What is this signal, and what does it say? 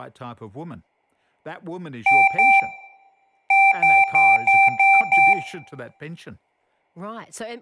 Beep code, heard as beeps from a small speaker, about 780 Hz, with room echo and speech in English. 2-6.